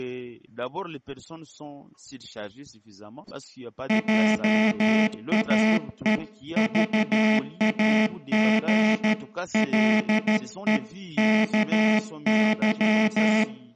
Morse code (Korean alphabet), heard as a buzzer, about 13 wpm, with room echo. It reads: 화롯가에